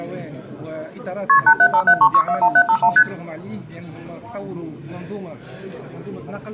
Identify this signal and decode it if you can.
Multi-frequency trunk signalling (R1, as on North American trunks), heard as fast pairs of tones, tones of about 70 ms, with room echo. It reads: KP 87573641751 ST